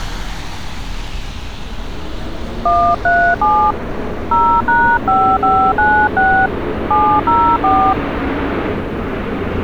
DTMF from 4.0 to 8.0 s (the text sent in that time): 0#5596 704